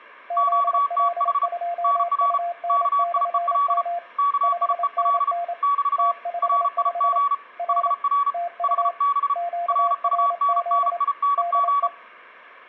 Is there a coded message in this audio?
Yes: Morse code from 0.2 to 11.9 s, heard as two keyed tones, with room echo. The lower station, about 27 wpm, 690 Hz: ZL2UN/M 5NN T55 R TU QRZ DE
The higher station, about 34 wpm, 1140 Hz: QTH NR KIEL KIEL <BT> RIG HR HB RUNNING